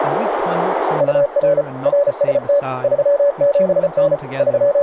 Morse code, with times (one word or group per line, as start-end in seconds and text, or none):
1.0-1.6 UR
1.9-2.6 RST
2.8-4.1 37N
4.4-4.8 …